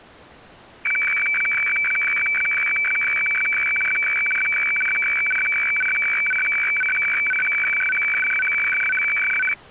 Weather fax (radiofax), 120 lines a minute, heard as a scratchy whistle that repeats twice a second.